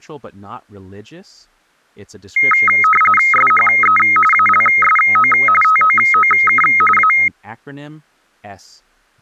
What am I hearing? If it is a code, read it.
RTTY (45.45 baud, 850 Hz shift), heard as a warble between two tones, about 1700 Hz centre. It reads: SHE ALSO TOOK A